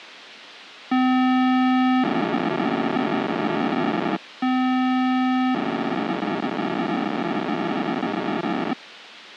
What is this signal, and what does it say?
POCSAG pager data (512 baud), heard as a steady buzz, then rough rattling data, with radio hiss.